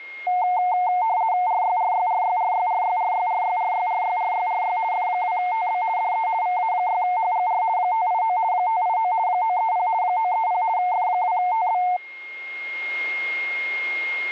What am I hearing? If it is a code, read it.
RTTY (50 baud, 170 Hz shift), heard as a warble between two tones, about 810 Hz centre, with a steady whistle near 2140 Hz. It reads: RYRYRYRYRYRYRYRYRYRYRY F2TB DE VA6HGR 589 589 930 930 F2TB